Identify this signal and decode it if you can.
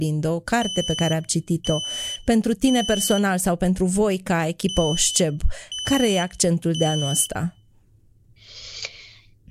Alarm pattern, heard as an alarm's beeps, played twice, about 3000 Hz, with room echo and speech in Romanian. Temporal three. Smoke or fire, evacuate.